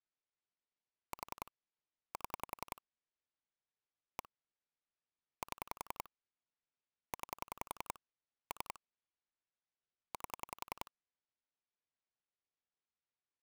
Pulse dialling, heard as clicks on a phone line, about 10 pulses a second. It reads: 4 7 1 7 9 3 8